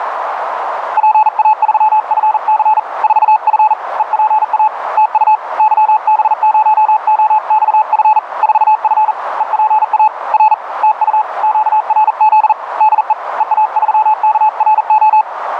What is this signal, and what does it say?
Morse code, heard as a keyed tone, hand-sent with a paddle, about 40 wpm, 860 Hz, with radio static and a narrow filter. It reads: PA3FC 4F EPA TU YB0OXF 4F EPA R TU QRZ DE EA3KRO